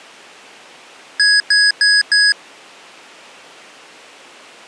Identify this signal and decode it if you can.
Beep code, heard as beeps from a small speaker, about 1650 Hz. 4 short. In AMI BIOS tables: system timer failure; in Dell tables: memory read or write failure.